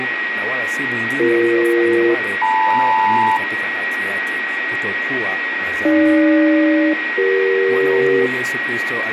Aircraft SELCAL, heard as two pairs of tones, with radio static, a steady whistle near 1900 Hz, room echo and speech in Swahili. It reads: BE-LM AG-CE